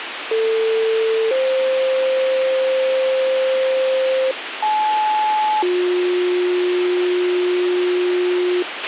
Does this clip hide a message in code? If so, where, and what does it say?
Yes: two-tone page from 0.3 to 8.6 s, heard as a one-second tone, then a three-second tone, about 450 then 520 Hz, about 860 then 360 Hz, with radio hiss and a squelch burst at the end.